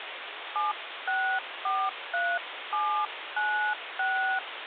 DTMF, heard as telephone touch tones, dialled by hand, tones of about 280 ms, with phone line noise. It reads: 7643796